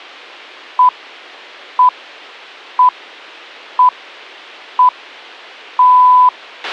Radio time signal (six pips, as the Greenwich Time Signal), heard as pips, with a squelch burst at the end.